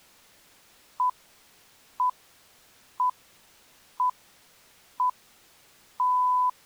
Radio time signal (six pips, as the Greenwich Time Signal), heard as pips.